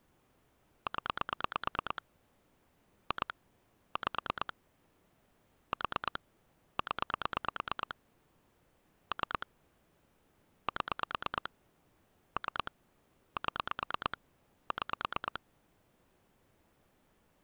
Pulse dialling, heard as clicks on a phone line, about 9 pulses a second. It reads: 0 2 5 4 0 3 7 3 7 6